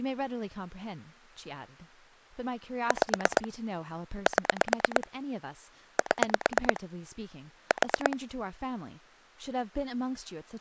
Pulse dialling, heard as clicks on a phone line, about 9 pulses a second, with speech in English. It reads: 5 7 7 4